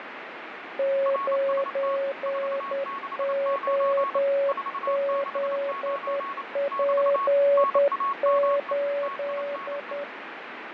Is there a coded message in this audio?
Yes: Morse code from 0.7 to 10.1 s, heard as two keyed tones, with radio static and fading. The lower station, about 10 wpm, 560 Hz: 9OZP8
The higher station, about 28 wpm, 1100 Hz: RST 469 469 <BT> NAME TINE